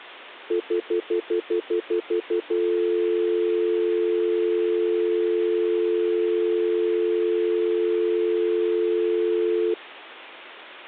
Telephone call progress tone (North American plan), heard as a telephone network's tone, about 350, 440 Hz, 0.1 s on and 0.1 s off. Stutter dial tone.